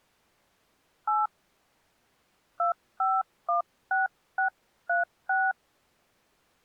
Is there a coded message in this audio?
Yes: DTMF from 1.1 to 5.5 s, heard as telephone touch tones, dialled by hand, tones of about 160 ms. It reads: 8 2516636